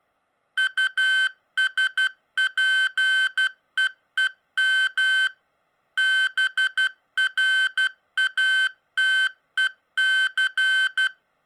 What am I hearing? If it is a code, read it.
Morse code (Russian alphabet), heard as electronic beeps, machine-sent, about 12 wpm, 1550 Hz. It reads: УСПЕЕМ БРАТЕЦ